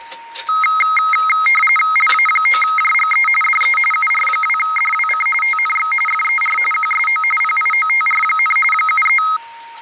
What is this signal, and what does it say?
RTTY (45.45 baud, 850 Hz shift), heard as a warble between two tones, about 1700 Hz centre, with a steady whistle near 930 Hz and kitchen noise. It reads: LA9JGE DE UR2DWC TNX FER QSO PIOTR, 73